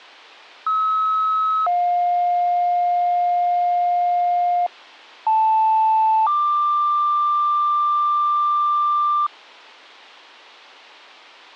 Two-tone page, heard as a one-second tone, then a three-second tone, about 1290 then 710 Hz, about 880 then 1180 Hz.